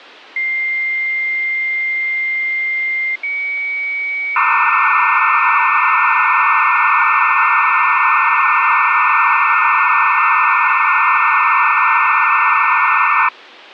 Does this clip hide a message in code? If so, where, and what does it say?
Yes: dial-up modem handshake (low-speed, two carriers) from 0.4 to 13.3 s, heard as two whistles, then hiss.